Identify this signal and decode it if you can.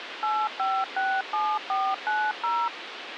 DTMF, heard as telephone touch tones, dialled by machine, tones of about 240 ms, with radio hiss. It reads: 8567490